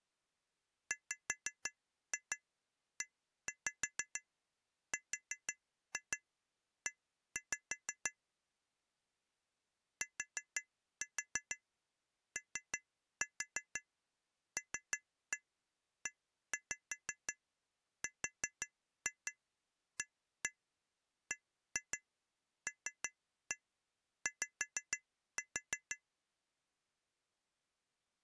Tap code, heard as taps on glass, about 5 knocks a second. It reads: WERE TOLERABLY